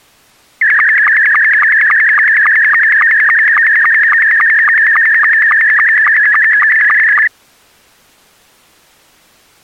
SSTV (slow-scan television), Scottie S2, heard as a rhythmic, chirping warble.